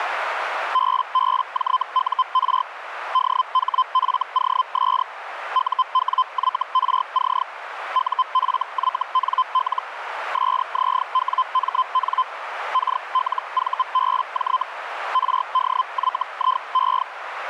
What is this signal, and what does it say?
Hellschreiber (Feld-Hell, 122.5 baud), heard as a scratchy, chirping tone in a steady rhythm, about 1030 Hz, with radio static and a narrow filter. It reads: BBJUR DHFOS UWYRC UFYNL SZWMN KLVBJ RDYIE